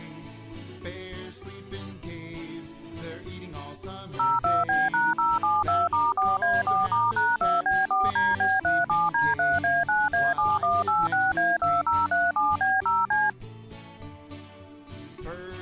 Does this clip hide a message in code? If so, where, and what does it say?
Yes: DTMF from 4.2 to 13.3 s, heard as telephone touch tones, dialled by machine, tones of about 200 ms. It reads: 02B#072*4A4*#2B4DB37D3A9A7186A2037B0C